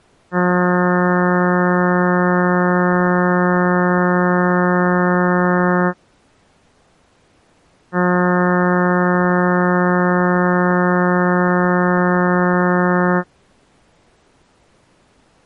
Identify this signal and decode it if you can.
Ship horn signal, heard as a ship's horn, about 180 Hz. 2 long. At sea: a vessel under power that has stopped in fog.